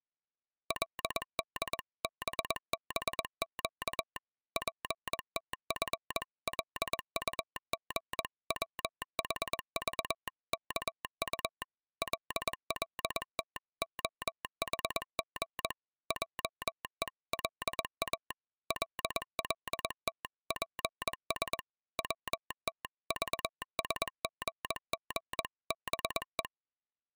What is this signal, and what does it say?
Morse code (Korean alphabet), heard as a telegraph sounder, machine-sent, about 21 wpm. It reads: 그때 전깃불이 꺼풋 하고 꺼져 버렸다